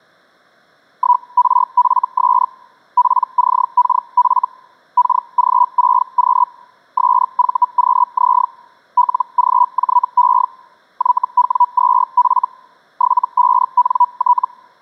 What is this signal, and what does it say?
Hellschreiber (Feld-Hell, 122.5 baud), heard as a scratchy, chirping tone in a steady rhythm, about 980 Hz. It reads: 1RFS PCKF KG6Q SVQZ LGJE YW2F 75NT